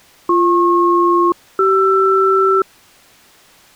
Aircraft SELCAL, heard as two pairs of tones. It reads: BP-CR